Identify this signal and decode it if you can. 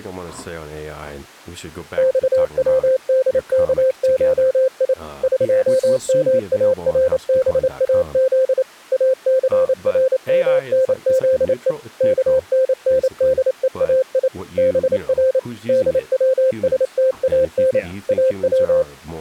Morse code (Persian alphabet), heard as a keyed tone, machine-sent, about 28 wpm, 520 Hz, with speech in English. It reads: خودکشی قمارباز اثرمنزه کنندهای بر دوستان او